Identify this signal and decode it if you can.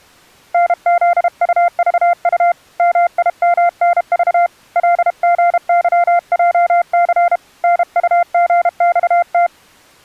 Morse code, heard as a keyed tone, hand-sent with a paddle, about 32 wpm, 700 Hz. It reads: NZUVU MIMNV LGYJC NUGXT